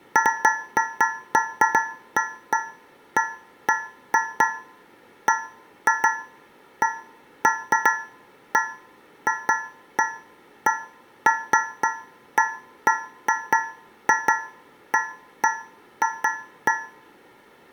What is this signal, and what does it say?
Irregular taps on a metal pipe, with room echo. There is no code.